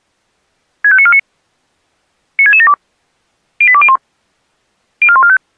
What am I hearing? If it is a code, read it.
Five-tone selective call (ZVEI), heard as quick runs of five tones, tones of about 70 ms. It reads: 65949 96672 08201 04145